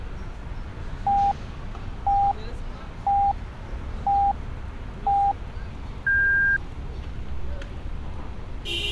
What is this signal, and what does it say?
Radio time signal (five pips and a higher one, as on Chinese radio), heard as pips, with street noise.